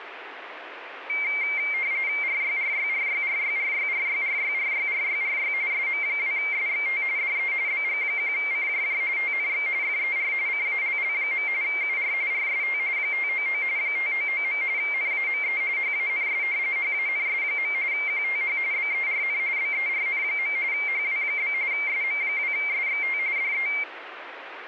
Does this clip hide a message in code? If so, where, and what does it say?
Yes: RTTY (45.45 baud, 170 Hz shift) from 1.1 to 23.8 s, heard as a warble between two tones, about 2200 Hz centre, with radio static. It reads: RYRYRYRYRYRYRYRYRYRY SM2SXT DE BG1CJJ TNX FER CALL. UR RST 599 599. NAME HANS HANS. QTH BERN BERN. HW? SM2SXT DE